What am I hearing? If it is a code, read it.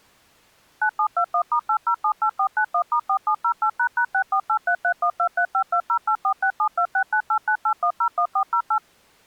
DTMF, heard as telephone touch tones, dialled by machine, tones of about 80 ms. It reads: 9721*8078491*4708##648331235208467269898101408